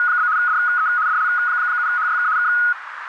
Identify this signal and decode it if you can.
RTTY (75 baud, 170 Hz shift), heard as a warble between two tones, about 1360 Hz centre, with radio static and a narrow filter. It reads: … DE DL7HYK K